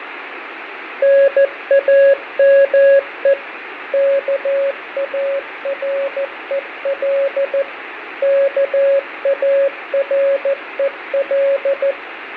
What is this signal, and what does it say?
Morse code, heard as a keyed tone, machine-sent, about 14 wpm, 550 Hz, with radio static and fading. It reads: NAME KAREL KAREL